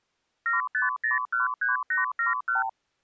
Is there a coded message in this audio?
Yes: multi-frequency trunk signalling (R2, with the far end's replies) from 0.5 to 2.7 s, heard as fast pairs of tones, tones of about 140 ms. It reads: 75013871